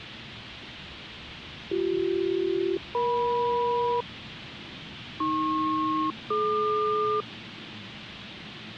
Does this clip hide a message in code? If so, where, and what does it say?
Yes: aircraft SELCAL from 1.7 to 7.2 s, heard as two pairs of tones, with the noise inside a subway train. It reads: BC-EM AP-DQ